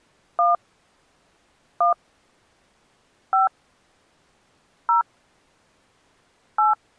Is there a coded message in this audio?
Yes: DTMF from 0.4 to 6.7 s, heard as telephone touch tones, dialled by hand, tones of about 130 ms. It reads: 1 1 5 0 8